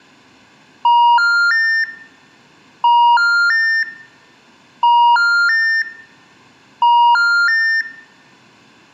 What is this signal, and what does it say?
Telephone call progress tone (ITU plan), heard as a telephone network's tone, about 950, 1400, 1800 Hz. Special information tone.